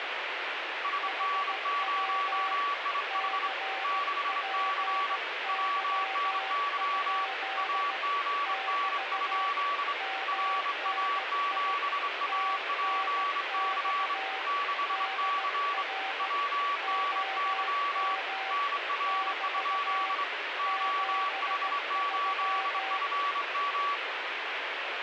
Morse code, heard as two keyed tones, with radio static. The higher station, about 25 wpm, 1140 Hz: SN0IH 6C WNY AGN? RA7APC 6C WNY NR? OH8FM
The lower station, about 16 wpm, 770 Hz: HW CPY? <BT> MNI TNX DR OM <BT> 73